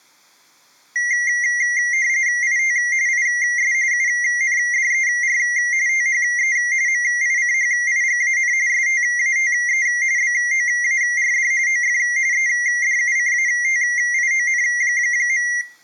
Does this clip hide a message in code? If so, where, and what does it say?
Yes: RTTY (45.45 baud, 170 Hz shift) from 1.0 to 15.6 s, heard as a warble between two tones, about 2000 Hz centre, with room echo. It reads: IT IS UNDER THE MICHIGAN STATE BOARD OF EDUCATION.